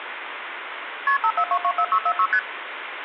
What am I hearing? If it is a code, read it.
Multi-frequency trunk signalling (R1, as on North American trunks), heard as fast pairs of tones, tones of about 70 ms, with phone line noise. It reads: KP 54224646 ST